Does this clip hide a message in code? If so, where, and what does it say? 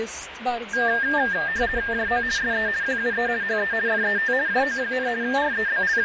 Yes: RTTY (50 baud, 170 Hz shift) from 0.7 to 6.1 s, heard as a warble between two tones, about 1700 Hz centre, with radio static and fading. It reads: JO SE QUE HE FET JO, …